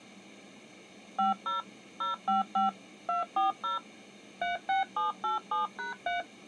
DTMF, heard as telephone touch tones, dialled by machine, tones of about 140 ms. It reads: 50 055 240 36787#3